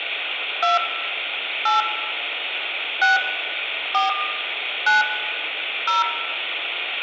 DTMF, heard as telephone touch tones, dialled by hand, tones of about 150 ms, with phone line noise and room echo. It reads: 2 8 6 4 9 0